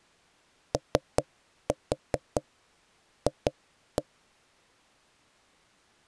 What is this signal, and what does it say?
Tap code, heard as knocks on wood, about 5 knocks a second. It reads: OF